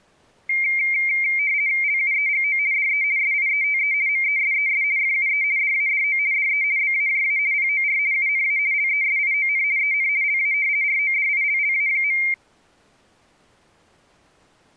RTTY (50 baud, 170 Hz shift), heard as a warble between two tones, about 2200 Hz centre. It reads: LUEGO DE SIETE MESES FUE DADO DE BAJA POR UNA LESION EN LA RODILLA.